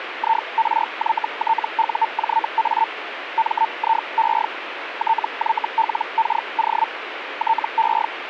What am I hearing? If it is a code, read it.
Hellschreiber (Feld-Hell, 122.5 baud), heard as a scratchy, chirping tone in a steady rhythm, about 900 Hz, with radio static. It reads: IRYTUJA MIE TYLKO TE